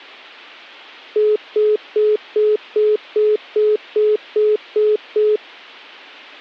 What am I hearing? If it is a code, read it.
Telephone call progress tone (single-tone plan, as in most of Europe), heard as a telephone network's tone, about 420 Hz, 0.2 s on and 0.2 s off. Congestion tone.